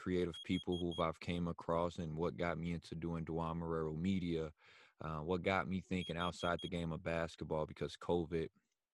Alarm pattern, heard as an alarm's beeps, played twice, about 3300 Hz, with speech in English. Temporal four. Carbon monoxide.